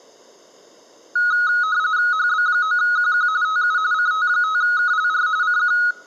RTTY (45.45 baud, 170 Hz shift), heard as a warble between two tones, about 1360 Hz centre, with room echo. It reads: HB9QQ TU CT5KLR CQ